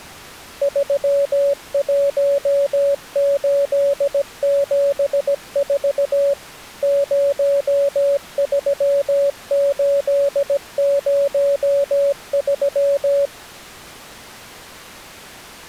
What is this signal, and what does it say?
Morse code, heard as a keyed tone, machine-sent, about 17 wpm, 560 Hz. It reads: 31874 03803